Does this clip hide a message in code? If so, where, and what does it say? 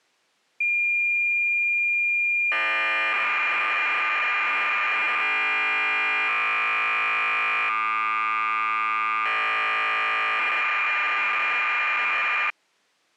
Yes: cassette data (Kansas City type), 1200 baud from 0.6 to 12.5 s, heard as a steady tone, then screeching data.